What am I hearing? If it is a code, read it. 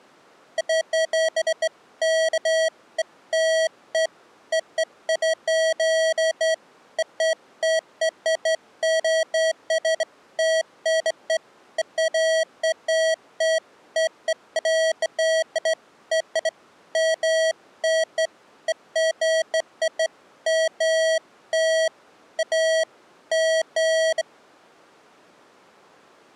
Beeps of irregular length. There is no code.